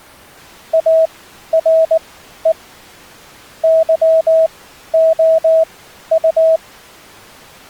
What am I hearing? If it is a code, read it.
Morse code, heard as a keyed tone, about 19 wpm, spaced as for 12 wpm, 650 Hz. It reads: ARE YOU